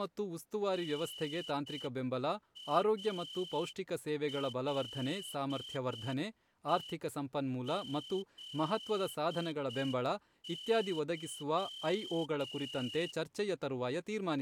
Morse code, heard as a whistle, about 6 wpm, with speech in Kannada. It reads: NALEZY